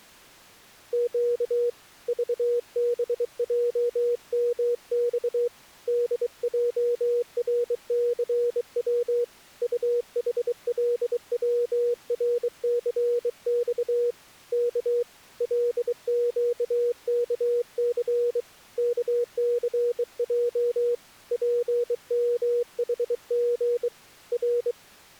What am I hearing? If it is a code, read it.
Morse code, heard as a keyed tone, hand-sent with a bug key, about 23 wpm, 480 Hz. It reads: Q VBJMX DJRCW UHLWRCX K LQKC KCJ PMHG R